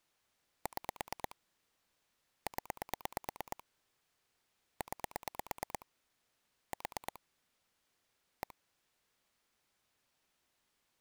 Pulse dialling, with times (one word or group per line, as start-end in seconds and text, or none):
0.7-1.4 6
2.5-3.6 0
4.8-5.9 9
6.7-7.2 4
8.4-8.5 1